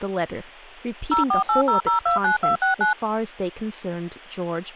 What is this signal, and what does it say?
DTMF, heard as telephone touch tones, dialled by machine, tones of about 130 ms, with speech in English. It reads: 0480029269